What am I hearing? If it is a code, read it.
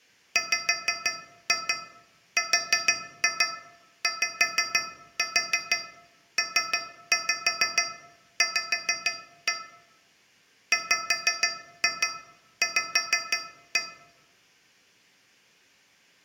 Tap code, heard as taps on a metal pipe, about 6 knocks a second, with room echo. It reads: WRYPV WV